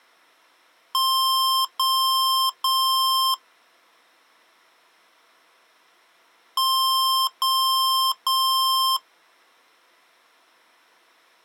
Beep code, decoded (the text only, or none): 3 long